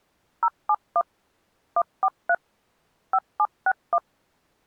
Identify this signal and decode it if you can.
DTMF, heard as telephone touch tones, dialled by machine, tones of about 60 ms. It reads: 071 143 5761